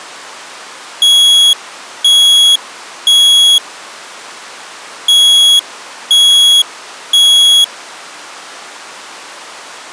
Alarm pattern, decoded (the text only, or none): temporal three